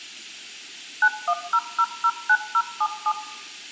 DTMF, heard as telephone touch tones, dialled by machine, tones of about 60 ms, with room echo. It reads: 910009077